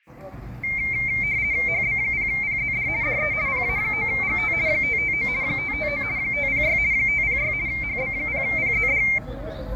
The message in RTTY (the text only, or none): HB0PZD DE PA9GT 559 559 506 506 HB0PZD